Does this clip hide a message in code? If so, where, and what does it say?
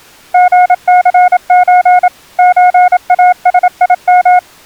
Yes: Morse code (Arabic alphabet) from 0.3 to 4.4 s, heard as a keyed tone, machine-sent, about 27 wpm, 720 Hz. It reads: غثز زاسيم